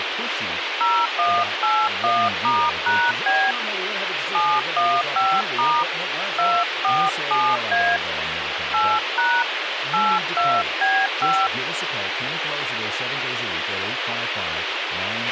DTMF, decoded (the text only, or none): 0181*#B 715* 247A 8# 82B5